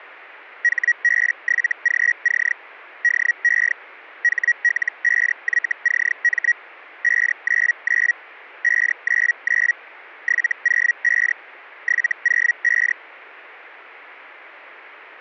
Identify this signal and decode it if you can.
Hellschreiber (Feld-Hell, 122.5 baud), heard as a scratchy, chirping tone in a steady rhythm, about 1900 Hz. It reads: HB7GC DE HL5YCM 599 599 705 705